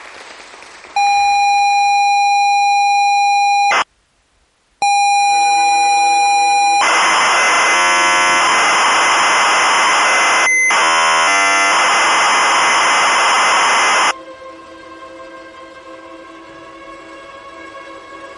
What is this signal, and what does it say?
ZX Spectrum tape loading, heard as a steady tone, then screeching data.